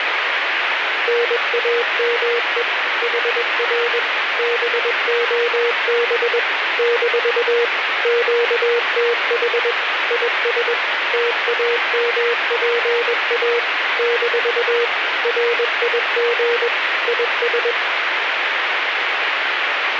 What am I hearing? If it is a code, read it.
Morse code, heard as a keyed tone, machine-sent, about 21 wpm, 470 Hz, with radio static. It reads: NAME HR BOB - QTH IS TAMPA - RIG IS